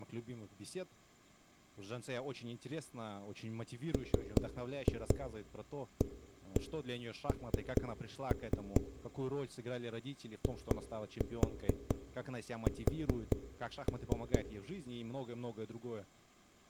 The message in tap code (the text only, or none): MAN IS